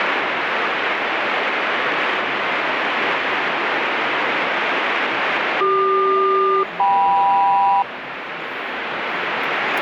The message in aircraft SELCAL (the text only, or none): CQ-KM